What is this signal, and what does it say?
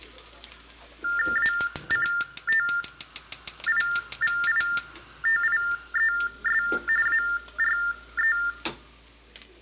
TTY/TDD text telephone tones (45.45 baud Baudot), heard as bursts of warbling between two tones, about 400 Hz shift, 1600 Hz centre, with room echo and kitchen noise. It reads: ACTIVITIES ARE